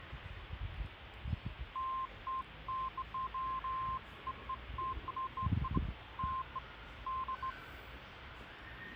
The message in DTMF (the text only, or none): none